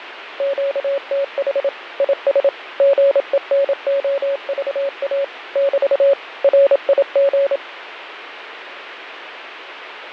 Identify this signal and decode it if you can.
Morse code, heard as a keyed tone, machine-sent, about 27 wpm, 560 Hz, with radio static and fading. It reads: QTH IS GENOVA <BT> RIG